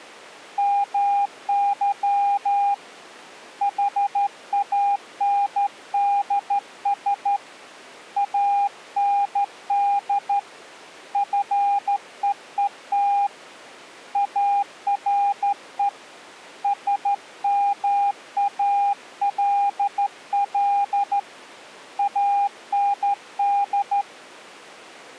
Morse code, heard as a keyed tone, hand-sent with a straight key, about 13 wpm, 810 Hz. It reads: MY HANDS AND FEET ARE SMALL AND